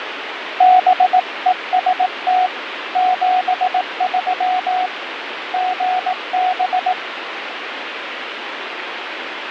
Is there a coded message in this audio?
Yes: Morse code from 0.5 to 7.0 s, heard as a keyed tone, hand-sent with a paddle, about 18 wpm, 740 Hz, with radio static and fading. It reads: BEST 73 GB